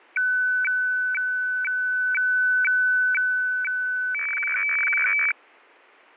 Weather fax (radiofax), 120 lines a minute, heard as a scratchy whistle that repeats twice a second.